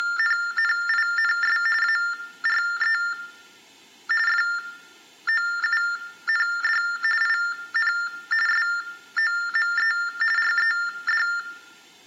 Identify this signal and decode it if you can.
TTY/TDD text telephone tones (45.45 baud Baudot), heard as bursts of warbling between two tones, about 400 Hz shift, 1600 Hz centre, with room echo. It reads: … ARE FOUND IN SOME RED